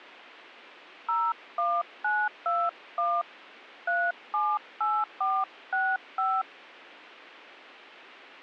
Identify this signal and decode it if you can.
DTMF, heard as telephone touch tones, dialled by hand, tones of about 240 ms. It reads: 01921 378465